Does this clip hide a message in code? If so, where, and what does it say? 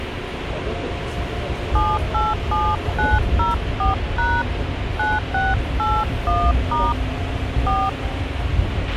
Yes: DTMF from 1.8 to 7.9 s, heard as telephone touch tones, dialled by hand, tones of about 190 ms, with radio hiss, a squelch burst at the end and the noise inside a subway train. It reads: 787904# 9681* 4